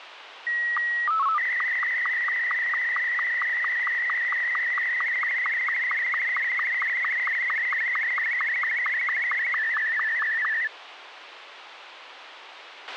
SSTV (slow-scan television), Martin M2, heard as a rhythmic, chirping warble, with radio hiss and a squelch burst at the end.